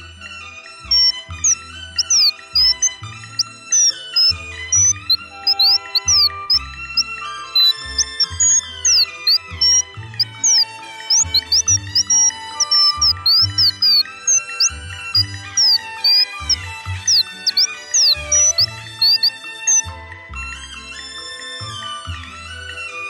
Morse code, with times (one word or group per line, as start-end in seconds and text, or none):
none